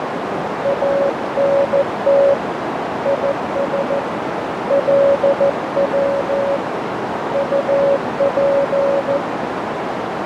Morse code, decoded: ANT IS LW UP

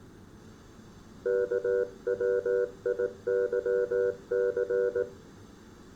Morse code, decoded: KWIYC

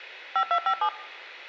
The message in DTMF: 5257

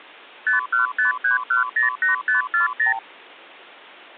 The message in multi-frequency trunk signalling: 5153108540

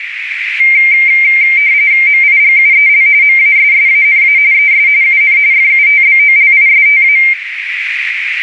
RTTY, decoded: MIGUEL MASSANA ES UN FUTBOLISTA

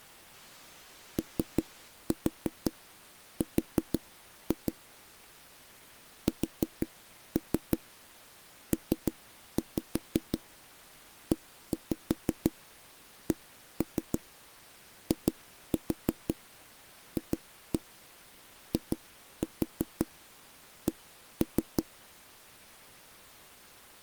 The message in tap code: OR SPECIFIC

